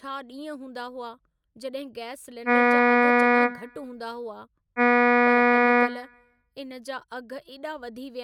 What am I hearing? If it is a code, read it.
Ship horn signal, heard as a ship's horn, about 240 Hz, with room echo and speech in Sindhi. 2 short. At sea: I am altering course to port.